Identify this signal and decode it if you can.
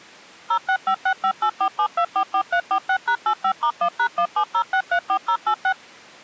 DTMF, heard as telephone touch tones, dialled by machine, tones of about 80 ms. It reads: 06565847244346#85*1#170634086